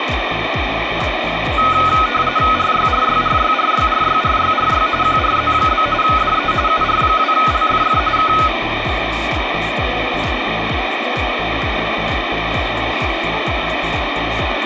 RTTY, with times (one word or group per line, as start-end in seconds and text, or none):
2.6-4.9 RYRYRYRYRYRYRY
5.0-5.9 QRZ?
6.0-6.5 DE
6.7-8.0 UR2LFF
8.2-8.3 K